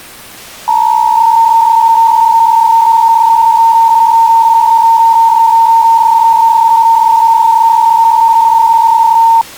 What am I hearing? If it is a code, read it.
PSK63 (62.5 baud), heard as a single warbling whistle, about 910 Hz.